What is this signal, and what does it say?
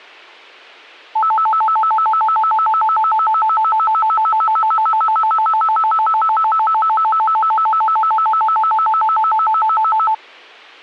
A tone that alternates evenly between two pitches. There is no code.